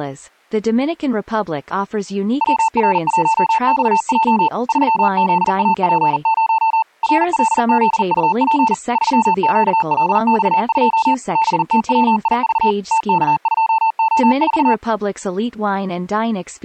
Morse code, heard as a keyed tone, machine-sent, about 40 wpm, 890 Hz, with speech in English. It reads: WR1XJ 3ZAP0 RLZUP 3QLX2 BTWIV TK2O4